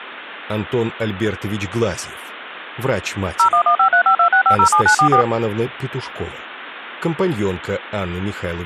DTMF, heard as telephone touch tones, dialled by machine, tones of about 90 ms. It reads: 01153526507944